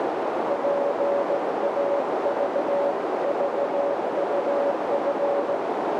Morse code (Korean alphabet), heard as a keyed tone, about 17 wpm, 570 Hz, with heavy radio static and a narrow filter. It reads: 졸린